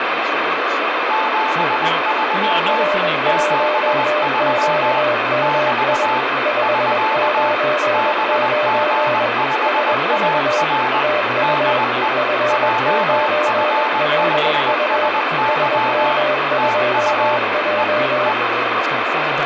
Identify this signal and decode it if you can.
Morse code, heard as two keyed tones, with radio static and speech in English. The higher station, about 20 wpm, 880 Hz: 73 73 <BT> <SK> BG5AR DE JF5SY TU E E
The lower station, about 21 wpm, 600 Hz: R1QMI 599 SV TU F9LU SM2J